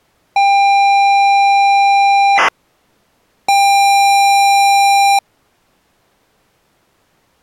ZX Spectrum tape loading, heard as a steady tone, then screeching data.